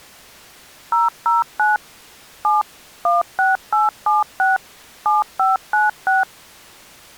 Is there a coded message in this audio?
Yes: DTMF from 0.9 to 6.2 s, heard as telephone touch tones, dialled by machine, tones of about 160 ms. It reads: 009 7 16876 7596